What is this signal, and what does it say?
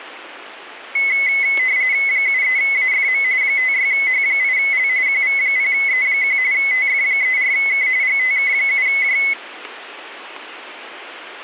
RTTY (45.45 baud, 170 Hz shift), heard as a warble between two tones, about 2100 Hz centre. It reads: 73AFM 56H8L QV0E1 TF34K GTK7J